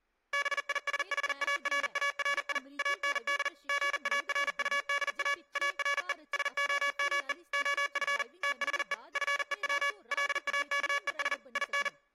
Morse code, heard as electronic beeps, machine-sent, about 40 wpm, 570 Hz, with speech in Dogri. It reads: BISHARARI AND GARUDA ARE SOME OF THE FEW LAKES IN